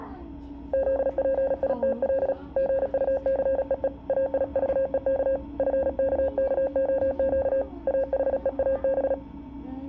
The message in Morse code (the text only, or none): ZPITL GUCEE AIVEK FKKOQ AHEAB